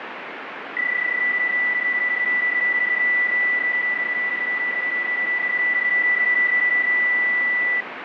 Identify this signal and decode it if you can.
PSK31 (31.25 baud), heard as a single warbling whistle, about 1950 Hz, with radio static.